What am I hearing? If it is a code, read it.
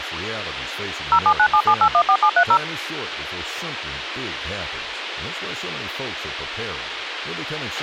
DTMF, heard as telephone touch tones, dialled by machine, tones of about 70 ms, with radio hiss, a squelch burst at the end and speech in English. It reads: 07977814730